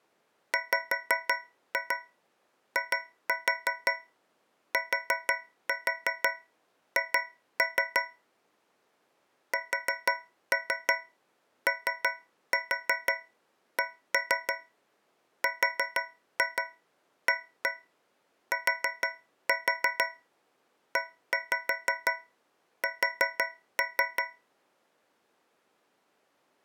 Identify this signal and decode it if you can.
Tap code, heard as taps on a metal pipe, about 6 knocks a second. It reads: WITH SOCRATES